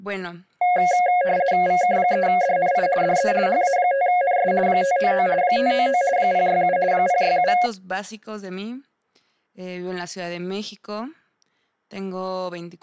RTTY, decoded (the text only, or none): VK3DNI DE HA5NS 599 599 067 067